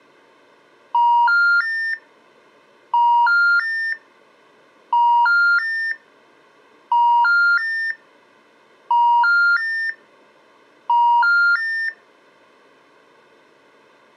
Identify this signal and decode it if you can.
Telephone call progress tone (ITU plan), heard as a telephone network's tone, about 950, 1400, 1800 Hz. Special information tone.